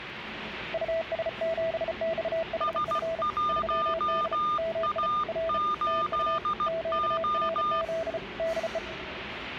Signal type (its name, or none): Morse code